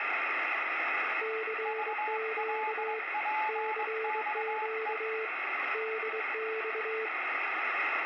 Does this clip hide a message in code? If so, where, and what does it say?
Yes: Morse code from 1.2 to 7.1 s, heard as two keyed tones, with radio static and room echo. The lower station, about 23 wpm, 440 Hz: CQ CQ DX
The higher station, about 21 wpm, 860 Hz: VLPXE